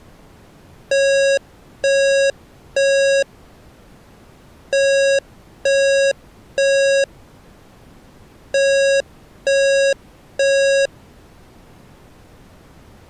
Alarm pattern, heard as an alarm's beeps, played three times, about 550 Hz. Temporal three. Smoke or fire, evacuate.